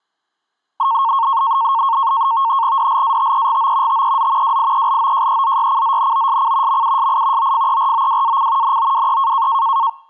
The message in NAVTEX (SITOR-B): DLATEGO TEZ WIELOJEZYCZNOSC MUSI OFEROWAC NOWE

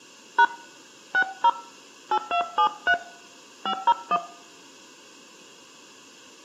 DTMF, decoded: # 60 8273 501

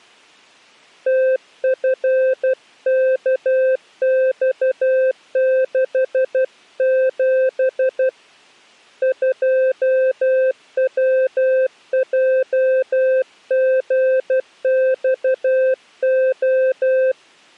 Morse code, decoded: TFKX67 2WJGXO

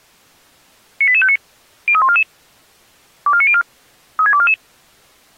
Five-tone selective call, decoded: 98859 03144 24904 36244

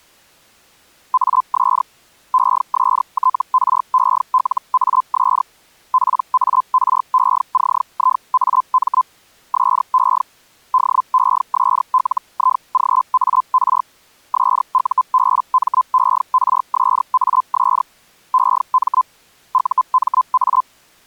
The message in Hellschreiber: AS ESTRELAS PARECIAM SE DESLIGAR SUBMERSAS EM UMA

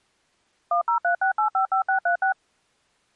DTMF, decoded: 1036855636

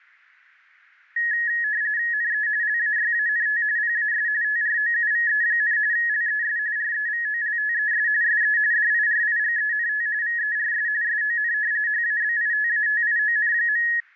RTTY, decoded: NE LAYANT PAS TROUVE, LES REVOLTES SE DIRIGENT VERS SON HABITATION.

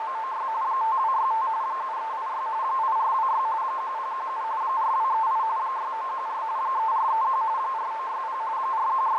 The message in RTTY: … 5265 7386 8426 1017 4238 6914 3431 4960 …

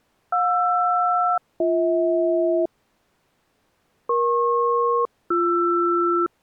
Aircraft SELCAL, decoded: JR-BH EP-BR

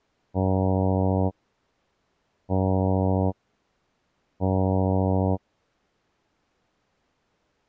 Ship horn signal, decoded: 3 short

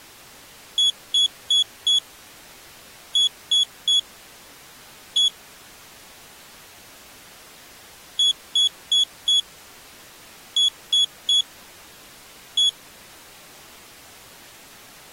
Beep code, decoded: 4-3-1

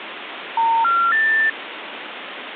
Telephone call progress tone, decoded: special information tone

